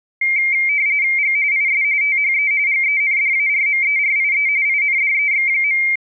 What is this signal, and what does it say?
RTTY (45.45 baud, 170 Hz shift), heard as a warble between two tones, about 2200 Hz centre. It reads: G IS THE GENDARMERIE INDEX.